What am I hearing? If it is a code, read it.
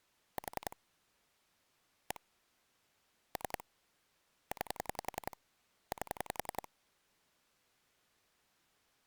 Pulse dialling, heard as clicks on a phone line, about 10 pulses a second. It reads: 4 1 3 9 8